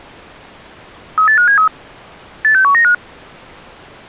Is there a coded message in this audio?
Yes: five-tone selective call (CCIR) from 1.2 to 2.9 s, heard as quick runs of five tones, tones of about 100 ms. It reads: 38573 86195